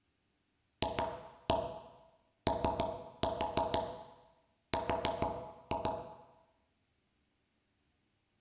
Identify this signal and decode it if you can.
Tap code, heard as taps on a metal pipe, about 6 knocks a second, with room echo. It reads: FOR